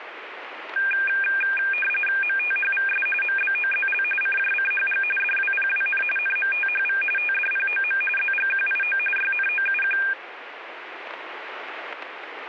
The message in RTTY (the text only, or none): MTHVS MBOZL CJCHG DWPWN NMTHV TDPOM ZGQIO YNOUQ